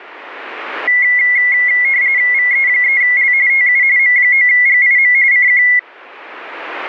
RTTY (45.45 baud, 170 Hz shift), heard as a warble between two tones, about 2050 Hz centre. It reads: VE3L TU M9GIM CQ